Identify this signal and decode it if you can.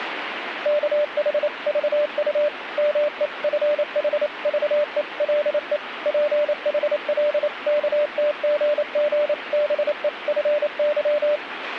Morse code (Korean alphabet), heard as a keyed tone, machine-sent, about 28 wpm, 590 Hz, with radio static. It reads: 우리 마누라가 죽었다네